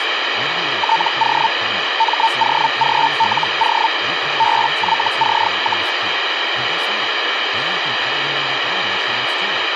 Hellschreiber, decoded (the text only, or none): TO MOGLO BYC,